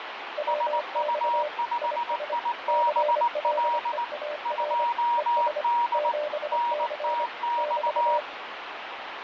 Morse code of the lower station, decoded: WX IS CLEAR ES 7C <BT>

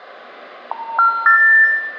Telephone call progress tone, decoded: special information tone

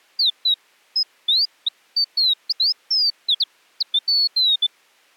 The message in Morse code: none

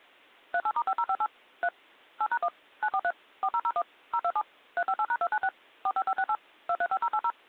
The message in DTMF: 38*5058 3 8#1 943 4001 027 358#296 45568 235080

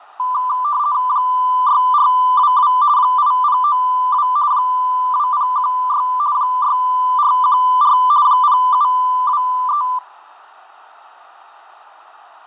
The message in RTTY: 6422 8092 2016 6414 0723

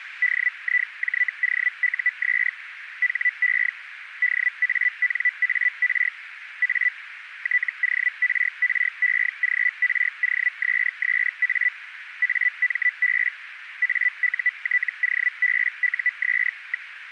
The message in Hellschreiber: DIJOUS HE DANAR A TORREGROSSA AMB AUTOBUS.

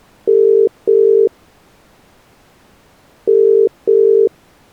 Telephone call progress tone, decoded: ringback tone

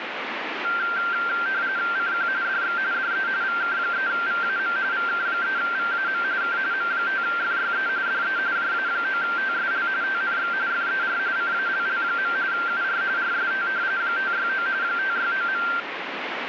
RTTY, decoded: CQ DX DE VK3VAM VK3VAM K M5FYE DE JA9TSL TNX FER CALL. UR RST 569 569.

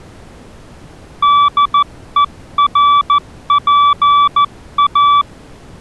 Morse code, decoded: DERPA

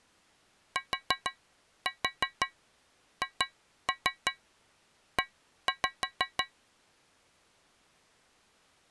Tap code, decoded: THE

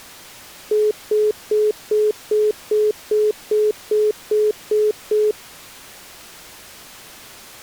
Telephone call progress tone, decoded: congestion tone

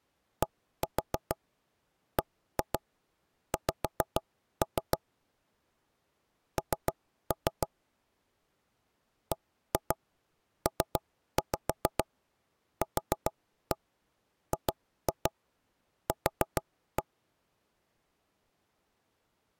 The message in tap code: DBX N BPQGQ

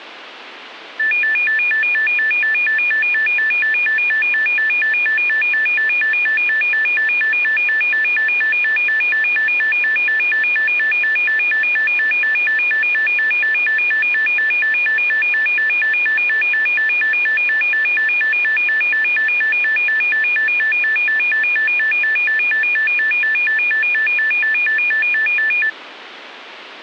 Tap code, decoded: none

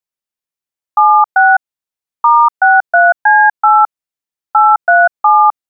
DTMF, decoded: 76 *63C8 837

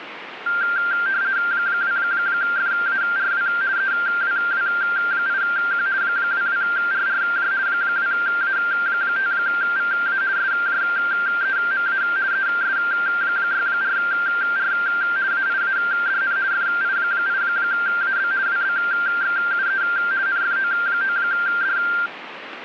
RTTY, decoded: 2FARW EWW8Q 22RRJ 2A5VA SJEMA ES64R AIADN FI8AB WBXUE NFO9D

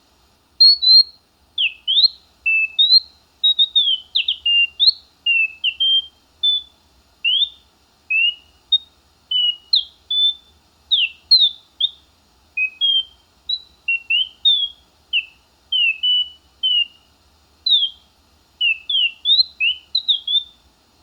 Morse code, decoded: none

